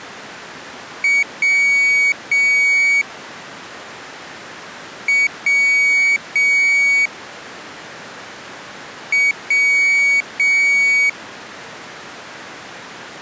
Beep code, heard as a piezo beeper, played three times, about 2250 Hz. 1 short, 2 long.